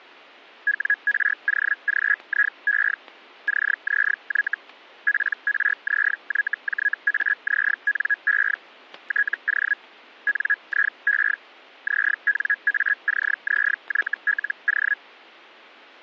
Hellschreiber (Feld-Hell, 122.5 baud), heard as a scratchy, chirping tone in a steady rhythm, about 1650 Hz, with static crashes. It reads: WROGIE CZY PRZYJAZNE TO NIE ZNACZYLO